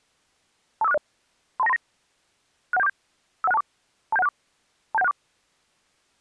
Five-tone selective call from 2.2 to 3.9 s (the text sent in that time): 61747 51624